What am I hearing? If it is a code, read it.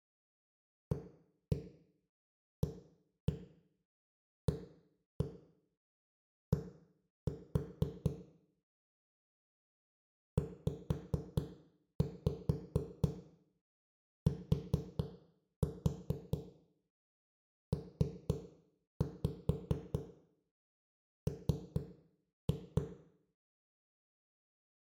Tap code, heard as knocks on a wall, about 4 knocks a second, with room echo. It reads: AAAD ZTPM